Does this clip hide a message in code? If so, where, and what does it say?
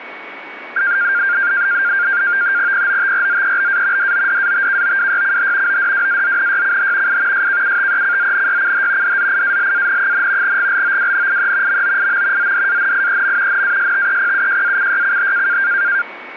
Yes: NAVTEX (SITOR-B), 100 baud, 170 Hz shift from 0.8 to 16.0 s, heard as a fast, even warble, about 1500 Hz centre, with radio static and a steady whistle near 2240 Hz. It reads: POTRZEBA DODATKOWYCH ODWAZNYCH I SKUTECZNYCH DZIALAN, GLOWNIE MOIM ZDANIEM NASTEPUJACYCH